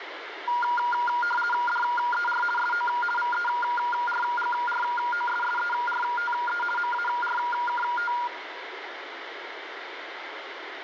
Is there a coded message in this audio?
Yes: RTTY (50 baud, 450 Hz shift) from 0.5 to 8.3 s, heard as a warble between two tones, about 1190 Hz centre, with radio static and room echo. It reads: DER SO VERGROSSERTE MARKT